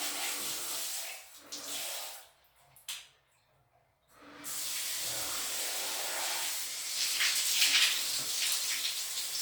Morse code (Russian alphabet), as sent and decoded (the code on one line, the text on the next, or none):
none